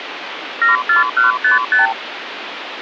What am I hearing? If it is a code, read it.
Multi-frequency trunk signalling (R2, with the far end's replies), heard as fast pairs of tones, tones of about 140 ms, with phone line noise. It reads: 74155